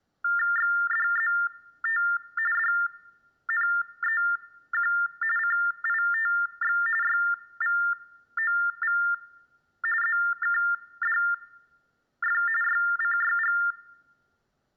TTY/TDD text telephone tones (45.45 baud Baudot), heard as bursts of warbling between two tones, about 400 Hz shift, 1600 Hz centre. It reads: XDZT DNEQ CITX YVOV ZKDF YCYG